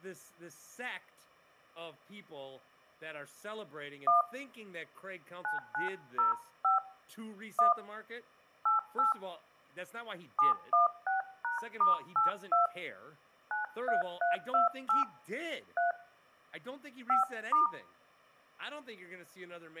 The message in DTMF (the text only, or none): 1 9905 1 88 716#*82 93328 3 5*